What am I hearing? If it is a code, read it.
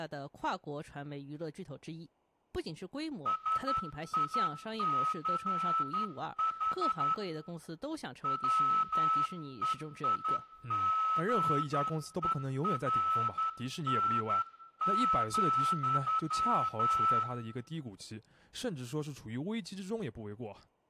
Morse code, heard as a whistle, hand-sent with a straight key, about 11 wpm, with room echo and speech in Chinese. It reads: SICH WEIGERN,